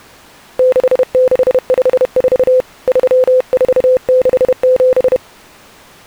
Morse code (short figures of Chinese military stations), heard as a keyed tone, hand-sent with a paddle, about 31 wpm, 510 Hz. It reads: 6654 3467